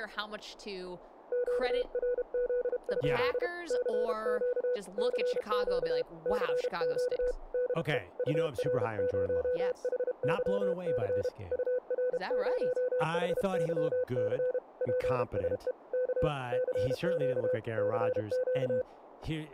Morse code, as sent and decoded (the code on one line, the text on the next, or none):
--.- .-. --.. ..--.. / -.-. --.- / -.-. --.- / -.-. --.- / -.. . / ..- .-. ----- .... -.-- -.-. / ..- .-. ----- .... -.-- -.-. / .--. ... . / -.- / -.-. --.- / -.-. --.-
QRZ? CQ CQ CQ DE UR0HYC UR0HYC PSE K CQ CQ